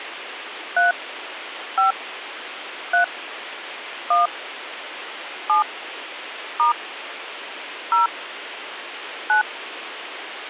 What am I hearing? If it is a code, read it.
DTMF, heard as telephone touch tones, dialled by hand, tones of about 130 ms, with radio hiss. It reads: 3 5 3 1 7 * 0 9